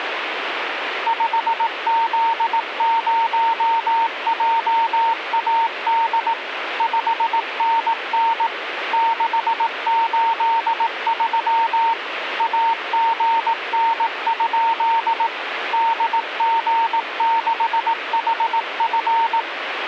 Morse code, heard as a keyed tone, machine-sent, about 18 wpm, 910 Hz, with radio static. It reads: 5Z0JAD 5NN 683 AGN? DG6HF